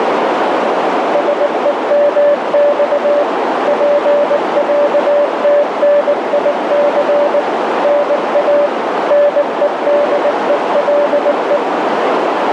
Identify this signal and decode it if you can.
Morse code (Russian alphabet), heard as a keyed tone, machine-sent, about 19 wpm, 580 Hz, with heavy radio static and a narrow filter. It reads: СЕМЬ ПЯТНИЦ НА НЕДЕЛЕ